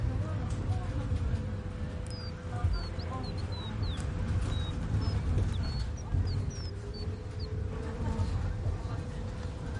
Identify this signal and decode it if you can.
Bird-like chirps, with the noise inside a bus. There is no code.